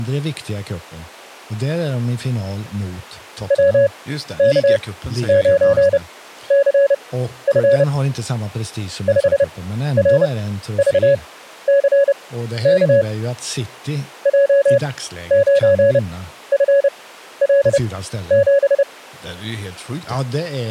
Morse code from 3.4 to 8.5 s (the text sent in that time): WK9CF